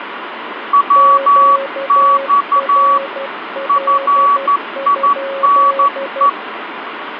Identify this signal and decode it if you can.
Morse code, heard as two keyed tones, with radio static. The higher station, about 12 wpm, 1140 Hz: WX FINE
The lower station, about 12 wpm, 550 Hz: QRL?